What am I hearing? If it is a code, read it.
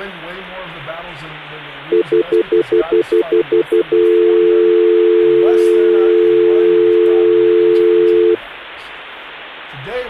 Telephone call progress tone (North American plan), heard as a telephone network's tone, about 350, 440 Hz, 0.1 s on and 0.1 s off. Stutter dial tone.